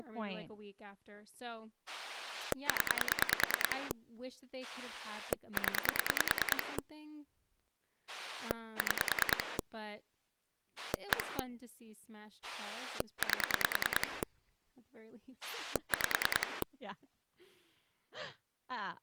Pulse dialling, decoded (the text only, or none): 0 0 6 1 8 5